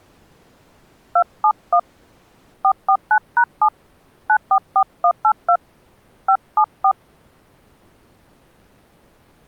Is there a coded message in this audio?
Yes: DTMF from 1.2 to 6.9 s, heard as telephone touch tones, dialled by hand, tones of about 70 ms. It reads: 271 449#7 944182 574